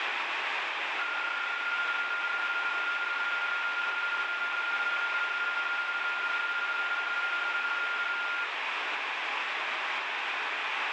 PSK31 (31.25 baud), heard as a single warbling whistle, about 1410 Hz, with radio static.